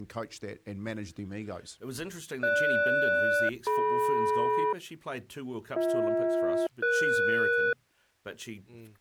Aircraft SELCAL, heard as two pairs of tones, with speech in English. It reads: GS-DM BH-ES